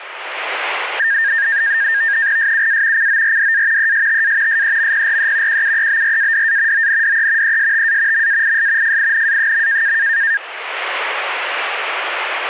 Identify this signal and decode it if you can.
NAVTEX (SITOR-B), 100 baud, 170 Hz shift, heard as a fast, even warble, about 1700 Hz centre, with radio static. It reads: SUA CORDA ESTA SEMPRE QUEBRADA ONDE ESTA MAIS FINA.